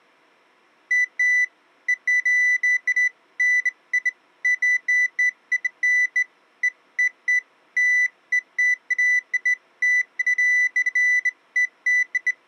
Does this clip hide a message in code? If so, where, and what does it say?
No, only beeps of irregular length.